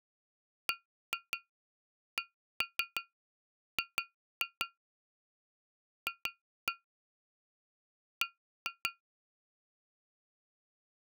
Tap code, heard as taps on glass, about 5 knocks a second. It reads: BCG F B